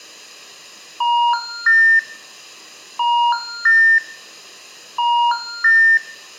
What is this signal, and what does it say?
Telephone call progress tone (ITU plan), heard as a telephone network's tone, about 950, 1400, 1800 Hz, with room echo. Special information tone.